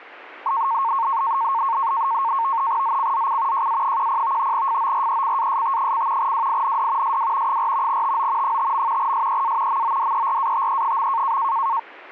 NAVTEX (SITOR-B), 100 baud, 170 Hz shift, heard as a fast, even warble, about 1000 Hz centre. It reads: ZCZC JA10 FORECAST: WIND SW 4 TO 5. SEA MODERATE.